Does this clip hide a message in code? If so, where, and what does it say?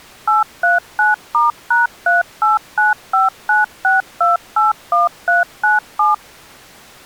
Yes: DTMF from 0.3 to 6.1 s, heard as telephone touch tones, dialled by machine, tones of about 160 ms. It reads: 839*#389596281397